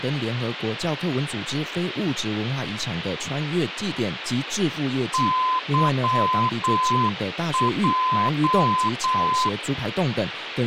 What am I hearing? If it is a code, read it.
Morse code, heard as a keyed tone, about 8 wpm, 1020 Hz, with radio hiss and speech in Chinese. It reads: YJ